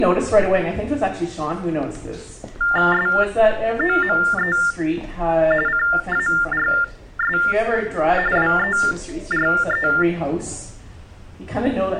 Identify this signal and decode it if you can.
TTY/TDD text telephone tones (45.45 baud Baudot), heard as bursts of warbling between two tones, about 400 Hz shift, 1600 Hz centre. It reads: SOME CARS WERE